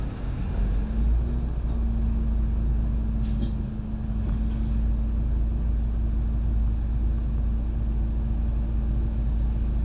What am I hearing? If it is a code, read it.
The noise inside a bus. There is no code.